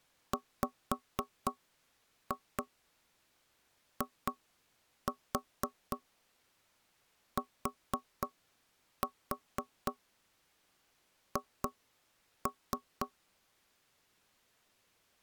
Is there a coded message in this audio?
Yes: tap code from 0.3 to 13.1 s, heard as knocks on wood, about 4 knocks a second. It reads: WITH